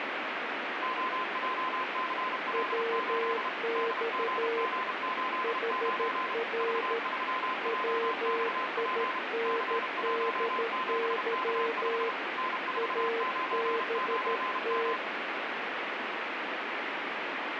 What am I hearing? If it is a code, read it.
Morse code, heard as two keyed tones, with heavy radio static. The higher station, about 32 wpm, 1030 Hz: OJCL8 DGG89 V3JXP C17K5 N499M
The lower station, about 13 wpm, 460 Hz: WX HR WINDY ABT